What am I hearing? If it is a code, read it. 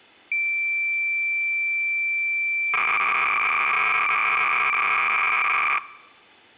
Cassette data (Kansas City type), 300 baud, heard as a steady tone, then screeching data.